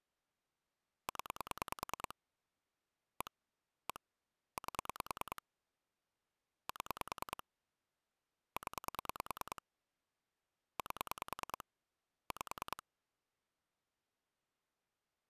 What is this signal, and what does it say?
Pulse dialling, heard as clicks on a phone line, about 9 pulses a second. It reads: 0 1 1 8 7 0 8 5